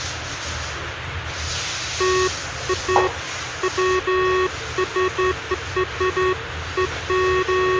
Beeps of irregular length, with phone line noise and the noise of a restroom. There is no code.